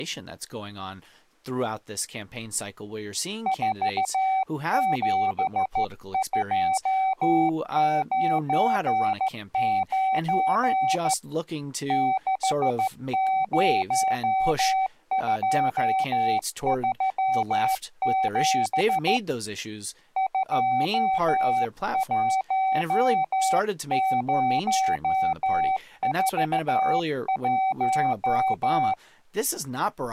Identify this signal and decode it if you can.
Morse code, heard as a keyed tone, hand-sent with a straight key, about 14 wpm, 760 Hz, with speech in English. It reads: 47299 60237 21041